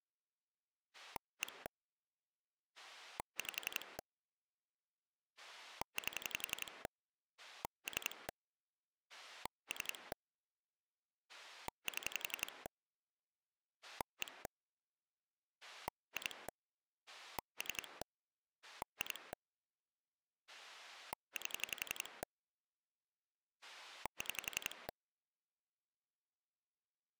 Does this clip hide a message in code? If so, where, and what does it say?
Yes: pulse dialling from 0.9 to 24.9 s, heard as a rotary dial, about 11 pulses a second. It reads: 1 5 8 3 3 7 1 2 3 2 8 6